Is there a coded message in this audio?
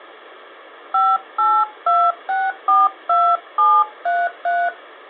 Yes: DTMF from 0.9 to 4.7 s, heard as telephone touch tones, dialled by hand, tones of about 220 ms. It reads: 582642733